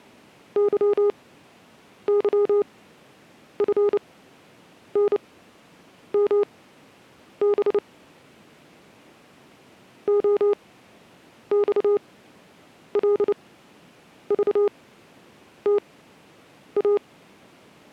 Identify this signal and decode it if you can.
Morse code, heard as a keyed tone, machine-sent, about 29 wpm, spaced as for 8 wpm, 410 Hz. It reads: YYFNMB OXLVTA